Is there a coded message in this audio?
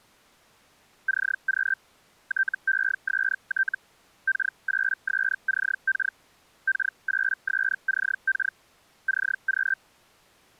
Yes: Hellschreiber (Feld-Hell, 122.5 baud) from 1.1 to 9.8 s, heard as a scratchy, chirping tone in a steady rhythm, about 1550 Hz. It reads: CQ TEST K8SCK K8SCK CQ